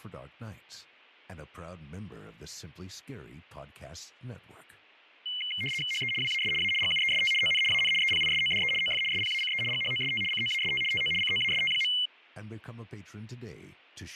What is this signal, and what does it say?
RTTY (75 baud, 850 Hz shift), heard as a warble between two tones, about 2550 Hz centre, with fading. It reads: HE WAS A GUEST ON AN EPISODE OF SPACE GHOST COAST TO COAST.